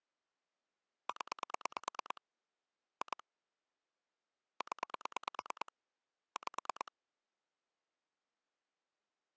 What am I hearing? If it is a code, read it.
Pulse dialling, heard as clicks on a phone line, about 9 pulses a second. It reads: 0 2 0 5